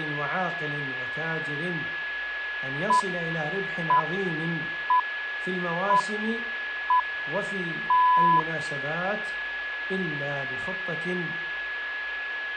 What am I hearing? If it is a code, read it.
Radio time signal (six pips, as the Greenwich Time Signal), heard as pips, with a steady whistle near 1690 Hz.